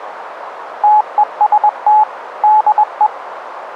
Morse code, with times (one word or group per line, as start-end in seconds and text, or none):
0.8-2.0 TEST
2.4-3.1 DE